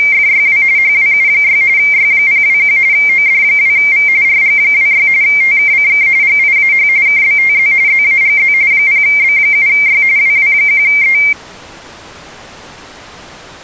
RTTY (45.45 baud, 170 Hz shift), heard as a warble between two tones, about 2200 Hz centre. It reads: … HWU6 Y021 OD2V RG26 TKCK GIAH KBTZ ZAGZ 0B7Y WW1E